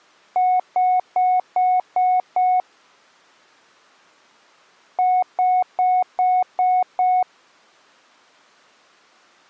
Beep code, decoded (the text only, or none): 6 short